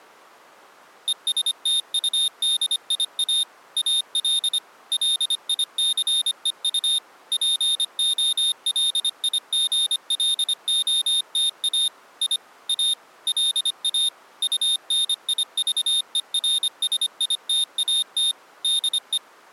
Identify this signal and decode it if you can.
Morse code, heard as a high beeper, machine-sent, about 25 wpm, 3650 Hz. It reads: ESTUDIA AL LICEU POLIGLOTA I A LA UNIVERSITAT DE